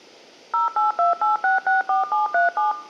DTMF, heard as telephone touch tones, dialled by machine, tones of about 140 ms. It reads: 0828664737